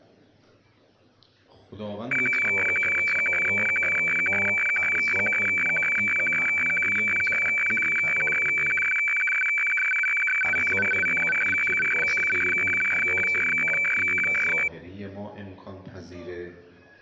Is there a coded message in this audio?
Yes: weather fax (radiofax), 120 lines a minute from 2.1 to 14.7 s, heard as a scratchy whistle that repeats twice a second.